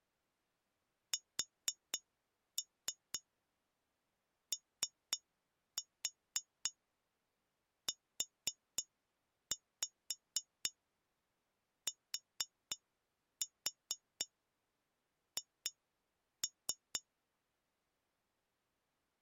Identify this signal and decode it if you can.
Tap code, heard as taps on glass, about 4 knocks a second. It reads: SOUTH